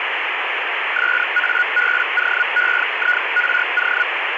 Hellschreiber (Feld-Hell, 122.5 baud), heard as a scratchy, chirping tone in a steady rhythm, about 1450 Hz, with radio static. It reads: SABOEIRO